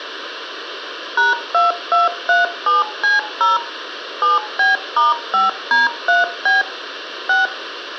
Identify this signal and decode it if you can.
DTMF, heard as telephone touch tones, dialled by machine, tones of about 160 ms, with radio hiss. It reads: #2237C0 7B*5D3B 6